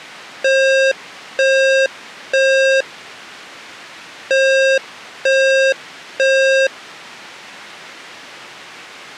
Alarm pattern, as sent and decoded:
3 beeps and a pause
temporal three

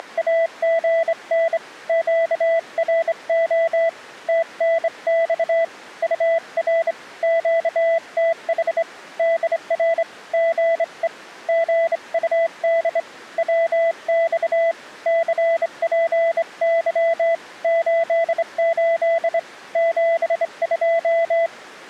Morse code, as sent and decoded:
… / --.- .-. --- / - -. -..- / ..- .-. / --.- - .... / -.. .-. / --. . / --. ..- -.. / .-- -..- / -.-. .--. -.-- / ---.. ---.. / --... ..---
… QRO TNX UR QTH DR GE GUD WX CPY 88 72

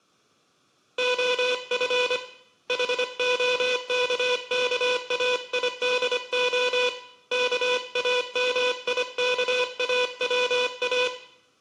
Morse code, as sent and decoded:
--- ..-. / .... --- -.- -.- .- .. -.. --- / -.- .- -- .. -.- .- .-- .-
OF HOKKAIDO KAMIKAWA

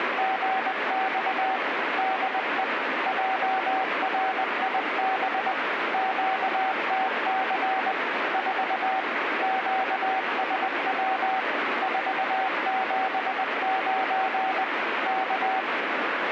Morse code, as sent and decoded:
… / -.. . / .--- .-. .. -... / --.- - -.-. / ....- / --.- ... .-- / ....- --... ----. / -.-
… DE JRIB QTC 4 QSW 479 K

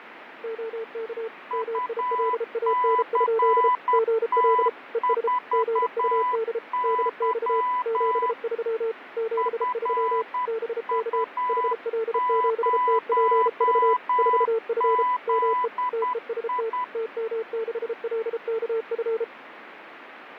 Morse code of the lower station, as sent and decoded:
--- -.- / -- .. .-.. .- -. ..--.. / --. .-.. / . ... / --. ..- -.. / -.. -..- / --... ...-- / --... ...-- / -... -.- / .... .-.. --... - .--. ...- / ....- ..-. / -- . / - . ... - / - -- -.... .-.. -.- ..-.
OK MILAN? GL ES GUD DX 73 73 BK HL7TPV 4F ME TEST TM6LKF

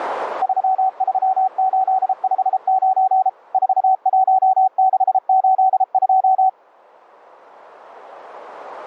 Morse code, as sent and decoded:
...-- ...-- ---.. ..... ----. / ....- .---- -.... ---.. ..---
33859 41682

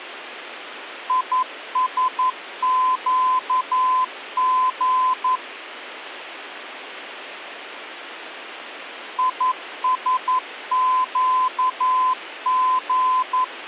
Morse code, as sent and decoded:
.. ... --.- --. / .. ... --.- --.
ISQG ISQG

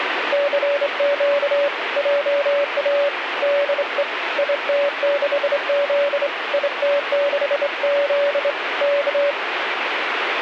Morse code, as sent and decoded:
-.-. --.- / .--- .- / -.. . / .. - -.... --.. / .. - -.... --.. / -.-
CQ JA DE IT6Z IT6Z K

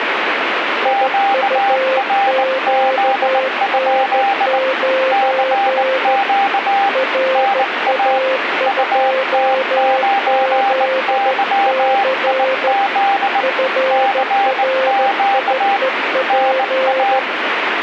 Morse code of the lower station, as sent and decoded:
.. ..- --.- -. ----. / .-. .- ..--- --.. -.-. / ..-. .-. .. . .--.
IUQN9 RA2ZC FRIEP

